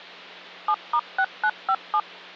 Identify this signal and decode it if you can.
DTMF, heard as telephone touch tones, dialled by machine, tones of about 60 ms, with hum. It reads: 7*6957